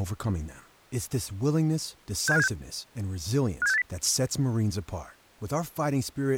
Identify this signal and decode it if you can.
Five-tone selective call (EEA), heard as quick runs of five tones, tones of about 40 ms, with speech in English. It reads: 67576 57680